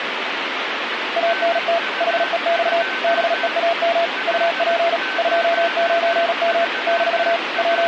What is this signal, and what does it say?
Morse code, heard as a keyed tone, machine-sent, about 37 wpm, 680 Hz, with radio static and a weaker station near 1530 Hz. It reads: ANT HEX BEAM UP 29M - …